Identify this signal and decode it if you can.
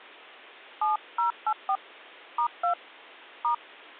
DTMF, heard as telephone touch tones, dialled by hand, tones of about 110 ms. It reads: 7084 *2 *